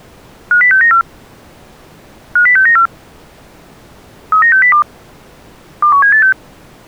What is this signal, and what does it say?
Five-tone selective call (CCIR), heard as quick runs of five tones, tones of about 100 ms. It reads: 50694 50694 39602 21786